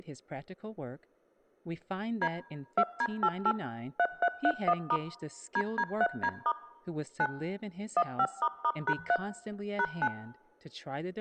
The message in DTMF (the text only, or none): D 2D88 3331* DD3D* 9 15**#3 #9